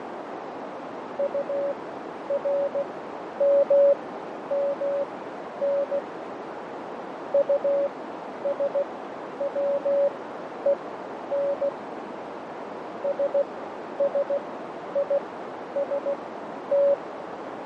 Morse code, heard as a keyed tone, machine-sent, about 16 wpm, spaced as for 10 wpm, 560 Hz, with radio static, fading and a narrow filter. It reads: URMMN USWEN SSIST